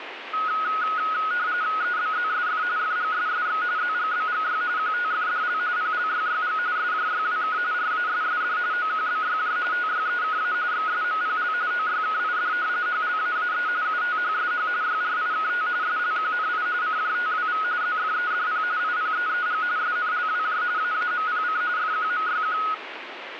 RTTY (45.45 baud, 170 Hz shift), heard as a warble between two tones, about 1360 Hz centre, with radio static. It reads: EBZSF FGSSX ZGBGY QTFDL PLYYG SJYWK RASSD OQBYJ TYEKA XSMPL OYKID HLAAE UTHSH YRIKT SLQNI CJTWV ZFEDP IPEEG SNLWJ AAMPC FQMYQ